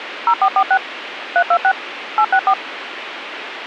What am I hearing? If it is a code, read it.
DTMF, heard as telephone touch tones, dialled by machine, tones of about 70 ms, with radio hiss and a squelch burst at the end. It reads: 0446 326 864